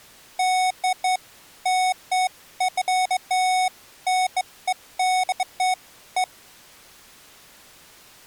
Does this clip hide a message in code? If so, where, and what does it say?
No, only beeps of irregular length.